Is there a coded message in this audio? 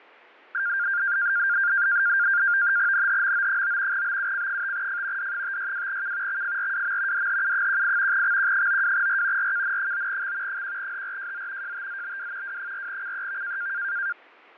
Yes: NAVTEX (SITOR-B), 100 baud, 170 Hz shift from 0.5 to 14.1 s, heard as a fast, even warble, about 1500 Hz centre, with fading. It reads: NHMO9 BUC5F D562K XFRWM DHU18 XQ92R RKN9X 1HRJZ JTZBW W4CEV